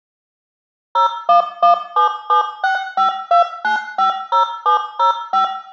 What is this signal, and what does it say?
DTMF, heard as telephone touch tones, dialled by machine, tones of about 120 ms, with room echo. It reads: 01177652950705